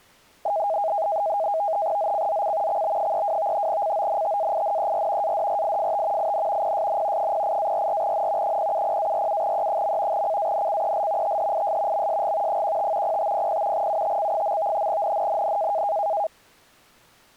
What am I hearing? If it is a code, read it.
NAVTEX (SITOR-B), 100 baud, 170 Hz shift, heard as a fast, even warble, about 730 Hz centre. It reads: ZCZC XB32 CONTAINER ADRIFT IN PSN 08-44N 070-47E. CANCEL THIS MSG 15 0500 UTC. NNNN